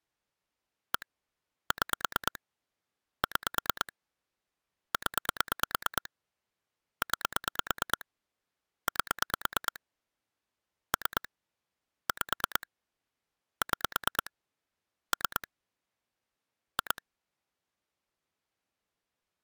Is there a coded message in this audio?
Yes: pulse dialling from 0.9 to 17.0 s, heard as clicks on a phone line, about 9 pulses a second. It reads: 1 6 6 0 9 8 3 5 6 3 2